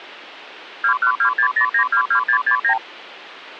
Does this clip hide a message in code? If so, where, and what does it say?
Yes: multi-frequency trunk signalling (R2, with the far end's replies) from 0.8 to 2.8 s, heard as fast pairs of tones, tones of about 90 ms. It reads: 21260922669